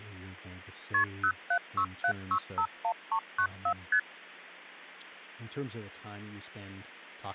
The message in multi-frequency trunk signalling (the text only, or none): KP 0767651394 ST